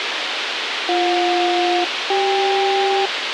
Aircraft SELCAL, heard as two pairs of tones, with radio hiss and a squelch burst at the end. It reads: BJ-CK